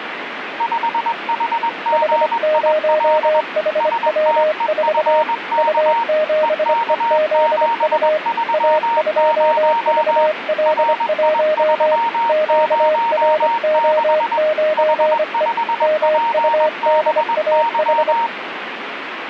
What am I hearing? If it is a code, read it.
Morse code, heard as two keyed tones, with radio static. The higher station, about 21 wpm, 930 Hz: 5HGIL STEFK EK730 RI306 H5PBY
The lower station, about 25 wpm, 620 Hz: H0HW4 U7EZU A2VL1 QRO9E MUDAH